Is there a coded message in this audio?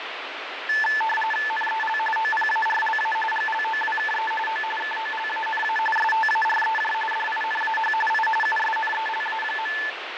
Yes: RTTY (45.45 baud, 850 Hz shift) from 0.7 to 9.9 s, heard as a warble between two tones, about 1310 Hz centre, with radio static and fading. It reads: NEL OPARLA GLOWKE O KOLANA STAREJ DINAH I USNELA.